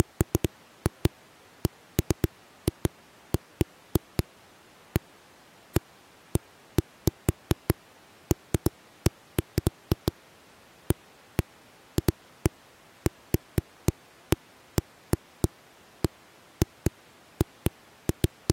Irregular knocks on a wall. There is no code.